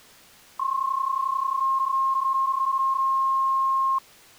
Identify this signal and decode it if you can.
PSK31 (31.25 baud), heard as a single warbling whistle, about 1070 Hz.